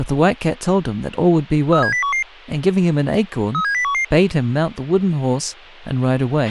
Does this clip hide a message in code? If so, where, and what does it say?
Yes: five-tone selective call (CCIR) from 1.7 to 4.0 s, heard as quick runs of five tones, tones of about 100 ms, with a squelch burst at the end and speech in English. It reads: 37011 37011